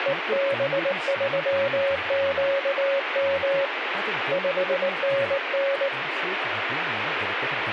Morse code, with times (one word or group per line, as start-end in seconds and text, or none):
0.1-3.7 EB3QM
4.3-5.9 5NN